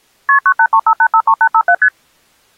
Multi-frequency trunk signalling (R1, as on North American trunks), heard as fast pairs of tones, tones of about 70 ms. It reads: KP 9835853857 ST